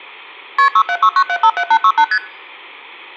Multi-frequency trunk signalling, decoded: KP 6769757868 ST

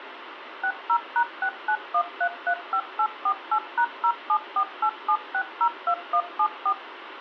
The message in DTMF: 60#691335848#07487602174

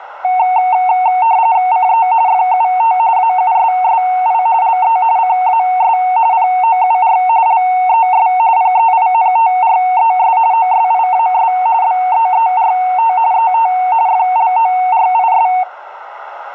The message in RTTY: CE FUT AUSSI LE CAS POUR LES PEINTRES OSIAS BEERT ET FLORIS

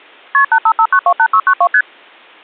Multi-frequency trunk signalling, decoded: KP 855928692 ST

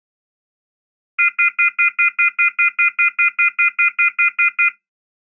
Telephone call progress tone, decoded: off-hook warning tone

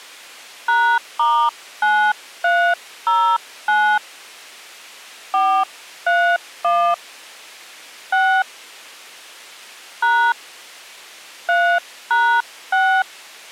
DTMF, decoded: #*9309 431 6 # 3#6

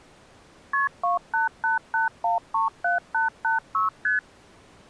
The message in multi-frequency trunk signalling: KP 2888137886 ST

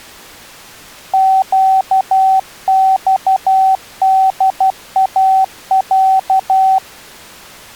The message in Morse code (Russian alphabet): ЩЬДАЯ

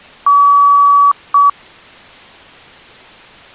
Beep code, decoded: 1 long, 1 short

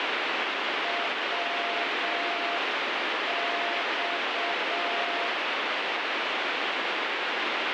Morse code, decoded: WX

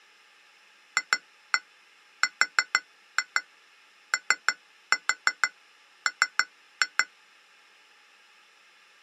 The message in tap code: FROM

